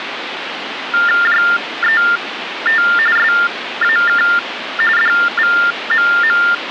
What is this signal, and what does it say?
TTY/TDD text telephone tones (45.45 baud Baudot), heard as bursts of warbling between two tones, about 400 Hz shift, 1600 Hz centre, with phone line noise. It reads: JET SAK DVMM